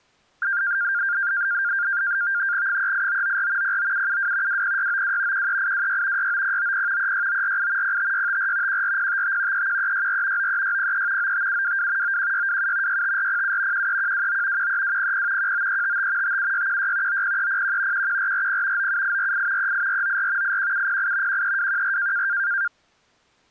NAVTEX (SITOR-B), 100 baud, 170 Hz shift, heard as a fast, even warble, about 1500 Hz centre. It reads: 38994 09772 20692 13826 69090 36948 05654 14055 31364 93603 95722 91627 65407 13129 13200 19355 57616 90301 11440 97848 38494 81708 13214